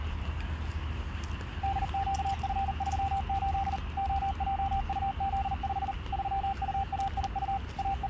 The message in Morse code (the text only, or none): DQF38 OJUZ5 3UAIU …